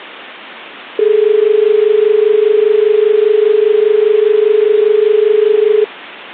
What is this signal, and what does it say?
Telephone call progress tone (as in Australia), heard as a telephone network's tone, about 430 Hz. Dial tone.